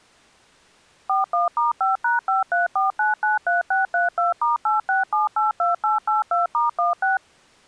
DTMF, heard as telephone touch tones, dialled by machine, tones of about 150 ms. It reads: 41*5#534993632*86782882*16